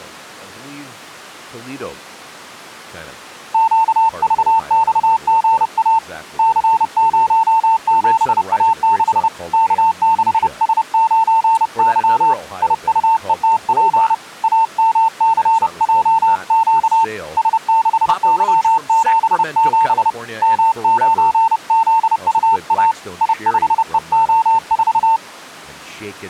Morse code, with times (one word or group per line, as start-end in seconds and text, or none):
3.5-6.0 QVXGA
6.4-9.3 C07A6
9.5-12.3 K6S9Y
12.6-14.1 IUETP
14.4-17.0 AMCJQ
17.4-20.1 S6Y77
20.4-22.9 M9ZUA
23.2-25.2 I5EO4